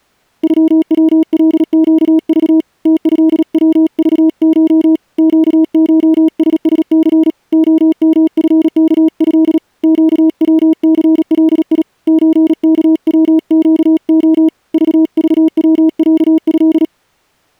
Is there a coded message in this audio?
Yes: Morse code (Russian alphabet) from 0.4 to 16.9 s, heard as a keyed tone, hand-sent with a paddle, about 37 wpm, 320 Hz. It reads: ЮВЛЩЖ ТЭВЖШ ЩШССЦ ОМФКЭ ЩВЦЛИ ЧКВЩО ЖЖВЯЭ